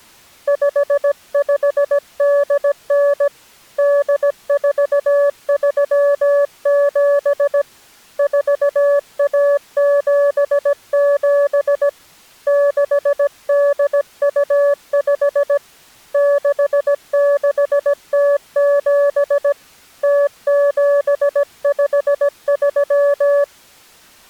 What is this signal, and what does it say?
Morse code (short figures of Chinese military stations), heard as a keyed tone, hand-sent with a paddle, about 17 wpm, 570 Hz. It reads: 5589 8437 4177 6825 6607 0753